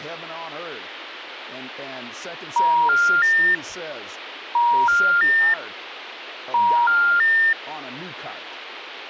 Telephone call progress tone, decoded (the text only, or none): special information tone